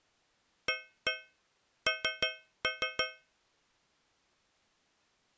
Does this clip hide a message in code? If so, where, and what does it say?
Yes: tap code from 0.7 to 3.3 s, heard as taps on a metal pipe, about 5 knocks a second. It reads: AN